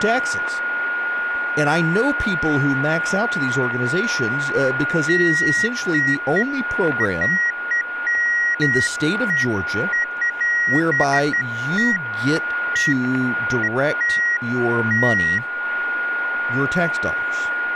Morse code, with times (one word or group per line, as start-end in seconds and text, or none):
none